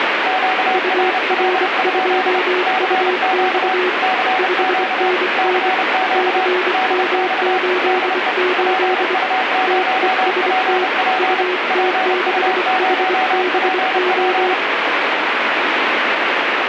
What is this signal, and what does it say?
Morse code, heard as two keyed tones, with heavy radio static. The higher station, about 30 wpm, 750 Hz: QRL? CQ CQ CQ DX DE PU0PP PU0PP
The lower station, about 24 wpm, 360 Hz: UR2UX 5NN CM88 TEST UT6HBO